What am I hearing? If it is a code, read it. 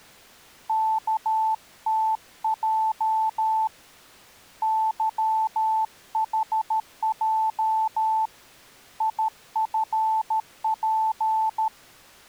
Morse code, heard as a keyed tone, hand-sent with a paddle, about 13 wpm, 880 Hz. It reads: KTJ YHJ IFP